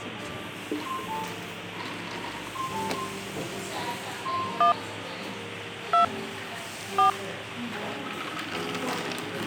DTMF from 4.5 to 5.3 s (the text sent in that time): 1